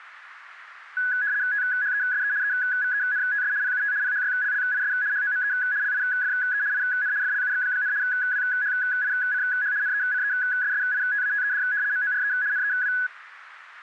RTTY (75 baud, 170 Hz shift), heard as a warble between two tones, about 1600 Hz centre, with radio static. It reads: THESE EVENTS PUT PHYLLIS HOME LIFE IN FLUX, WHICH NECESSITATED MORE NEW